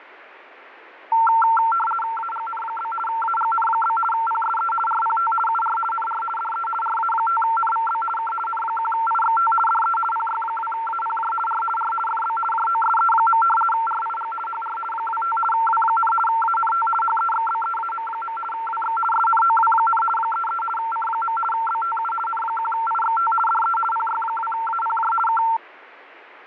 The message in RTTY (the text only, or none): AGN? AGN? PSE RPT UR NR DE RA5NVB K N1IXT DE PY2APJ R R FB JOSE. RIG HR 25 W, ANT HEXBEAM. WX SNOW, 33 C. BTU N1IXT DE PY2APJ K